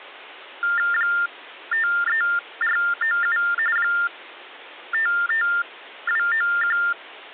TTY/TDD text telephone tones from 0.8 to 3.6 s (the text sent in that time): 53497